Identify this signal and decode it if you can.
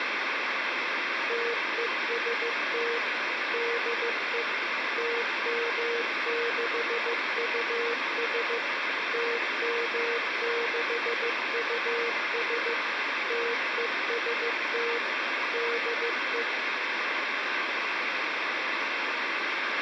Morse code, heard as a keyed tone, machine-sent, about 15 wpm, 470 Hz, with radio hiss, a squelch burst at the end and speech in Portuguese. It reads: TEST DE TM6US TM6US TEST DE